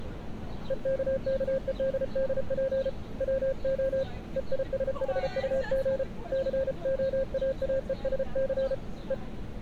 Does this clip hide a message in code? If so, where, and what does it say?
Yes: Morse code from 0.6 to 9.2 s, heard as a keyed tone, hand-sent with a paddle, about 33 wpm, 530 Hz, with street noise. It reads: EKKEDDP WO EISHUG COAAESC E